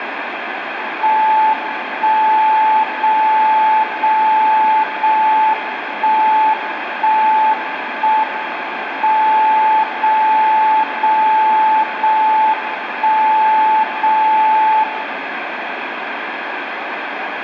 Radio time signal (JJY), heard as a tone whose level steps once a second, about 870 Hz, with radio static and room echo. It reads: 1 0 0 0 1 1 1 M 0 0 0 1 0 0